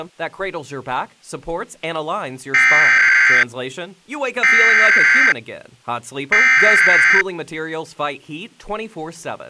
Emergency Alert System (SAME) tones (header bursts), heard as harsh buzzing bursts, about 520.83 baud.